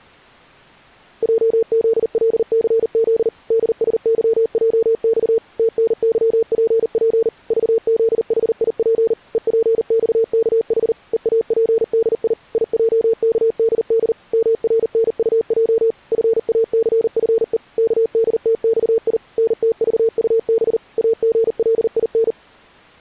Morse code, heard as a keyed tone, machine-sent, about 39 wpm, 450 Hz. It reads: JZLCZ DSYJX TNYPP VZHIP EPXKH EAPDI IJKDD MRNUJ FACFE KDTXI NTVUB AGLIN